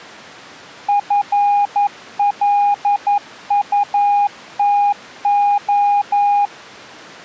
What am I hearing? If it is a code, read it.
Morse code, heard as a keyed tone, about 11 wpm, 820 Hz. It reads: FLUTO